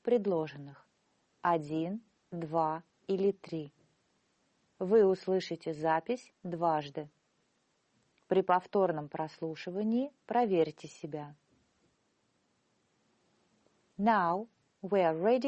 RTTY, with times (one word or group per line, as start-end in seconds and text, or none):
none